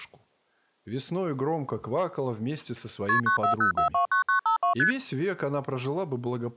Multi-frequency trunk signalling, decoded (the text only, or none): KP 940429952 ST